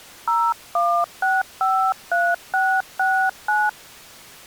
DTMF, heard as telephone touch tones, dialled by hand, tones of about 250 ms. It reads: 01653669